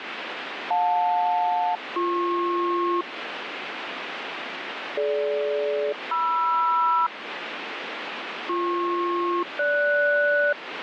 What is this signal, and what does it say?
Aircraft SELCAL, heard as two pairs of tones, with radio static. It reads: JL-BP DG-MR BP-GS